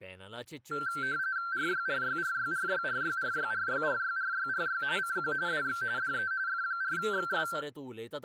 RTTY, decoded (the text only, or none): RYRYRYRYRYRYRYRYRYRY CQ DX DE F4XS